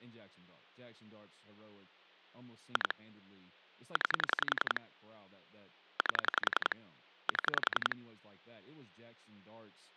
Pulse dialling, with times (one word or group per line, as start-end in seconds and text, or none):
2.8-2.9 2
4.0-4.8 9
6.0-6.8 8
7.3-8.0 7